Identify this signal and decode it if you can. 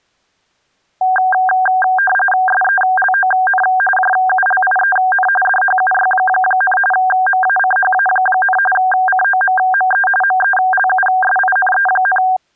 RTTY (45.45 baud, 850 Hz shift), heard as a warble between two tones, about 1170 Hz centre. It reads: SELON JULIEN DHUY, MACHA, COMME MELUSINE,